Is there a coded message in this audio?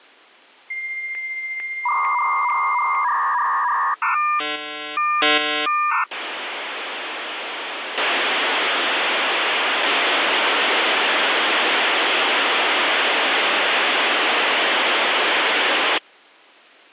Yes: dial-up modem handshake (V.34 or later) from 0.7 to 16.0 s, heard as a whistle, warbles, then hiss.